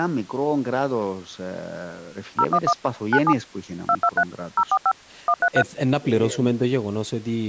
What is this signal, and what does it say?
DTMF, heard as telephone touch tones, dialled by machine, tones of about 60 ms, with speech in Greek. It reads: 011 97 223 045 133